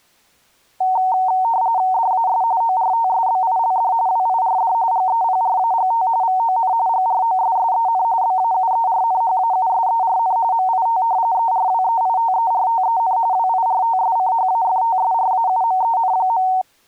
RTTY (45.45 baud, 170 Hz shift), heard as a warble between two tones, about 830 Hz centre. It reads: DAS ORTSBILD WIRD GEPRAGT VON GROSSEN BAUERNHAUSERN MIT ERWEITERTEN WIRTSCHAFTSRAUMEN.